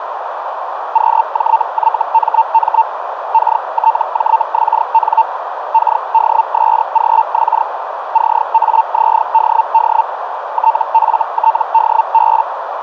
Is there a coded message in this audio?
Yes: Hellschreiber (Feld-Hell, 122.5 baud) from 0.9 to 12.4 s, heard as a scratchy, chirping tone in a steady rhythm, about 900 Hz, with radio static and a narrow filter. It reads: QJYMM KTJXN KDSGX CAZDD TFTDB